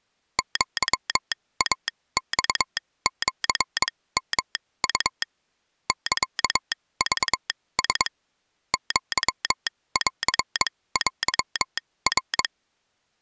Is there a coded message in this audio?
Yes: Morse code (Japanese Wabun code) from 0.3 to 12.5 s, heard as a telegraph sounder, machine-sent, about 22 wpm, spaced as for 17 wpm. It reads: アイマシヨウ サクラ アンテナ